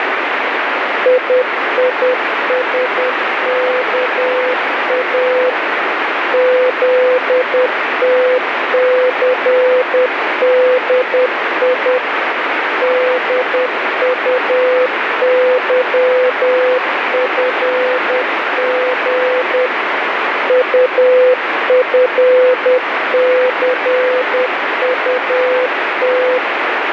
Morse code, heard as a keyed tone, machine-sent, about 10 wpm, 510 Hz, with heavy radio static. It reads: IISKA ZTCDI DUYFG UFCUT